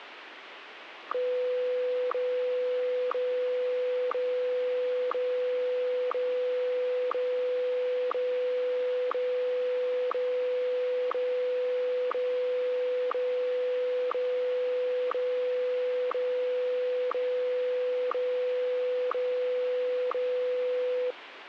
Radio time signal (WWVH, Hawaii), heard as ticks, one a second, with radio static.